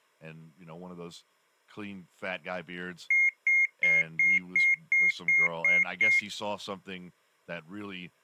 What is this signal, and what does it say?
Beep code, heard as beeps, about 2150 Hz, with speech in English. 9 short. In AMI BIOS tables: ROM checksum failure.